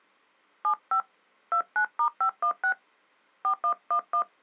DTMF, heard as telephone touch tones, dialled by hand, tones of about 90 ms. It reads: 75 29*516 4111